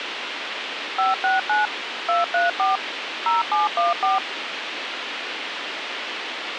DTMF, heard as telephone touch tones, dialled by machine, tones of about 160 ms, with radio hiss. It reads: 569 234 0714